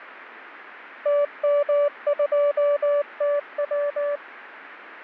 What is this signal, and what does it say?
Morse code, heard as a keyed tone, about 19 wpm, 580 Hz. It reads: TM2TW